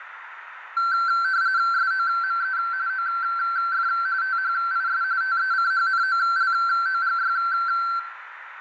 RTTY (45.45 baud, 170 Hz shift), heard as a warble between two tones, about 1450 Hz centre, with radio static, a narrow filter and room echo. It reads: SOME OF THIS TECHNOLOGY